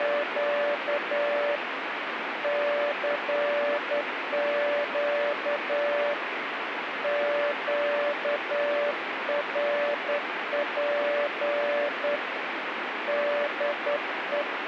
Morse code, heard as a keyed tone, hand-sent with a straight key, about 10 wpm, 580 Hz, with radio static. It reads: … CQ QRP DE